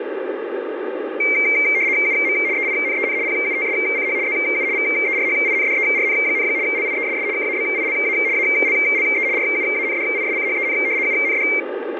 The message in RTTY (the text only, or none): UM EINEN PUTSCH ZU VERHINDERN, LIESS KABILA ALLE RUANDISCHEN UND